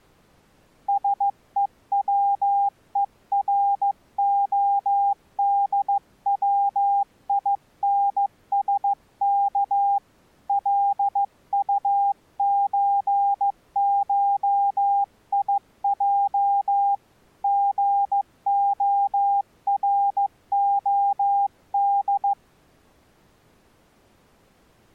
Morse code (Russian alphabet), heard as a keyed tone, hand-sent with a paddle, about 15 wpm, 800 Hz. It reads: СЕВЕРОДВИНСК ЛУЧШИЙ ГОРОД